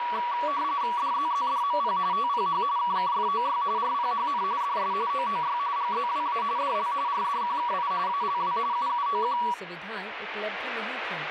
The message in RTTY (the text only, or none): DZZDMP TPH KKFOY RPHN DS OOY GZWA DL RDQKI ALW UUOQ